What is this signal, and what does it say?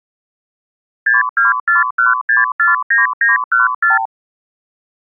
Multi-frequency trunk signalling (R2, with the far end's replies), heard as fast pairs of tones, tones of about 150 ms. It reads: 6241649914